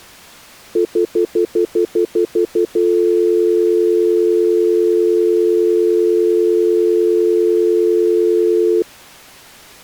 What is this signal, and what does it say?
Telephone call progress tone (North American plan), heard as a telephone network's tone, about 350, 440 Hz, 0.1 s on and 0.1 s off. Stutter dial tone.